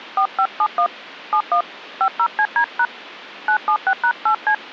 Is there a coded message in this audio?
Yes: DTMF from 0.2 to 4.5 s, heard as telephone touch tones, dialled by hand, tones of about 80 ms. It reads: 4571 71 50CD# 976#8C